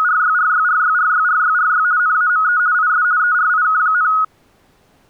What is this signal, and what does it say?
RTTY (50 baud, 170 Hz shift), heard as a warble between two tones, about 1360 Hz centre. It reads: … NAME IS ERIK,